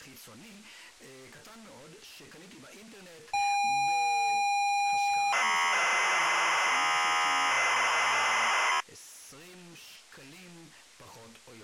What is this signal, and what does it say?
ZX Spectrum tape loading, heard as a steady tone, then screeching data.